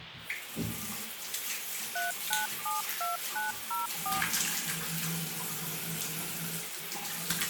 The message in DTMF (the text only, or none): 3972904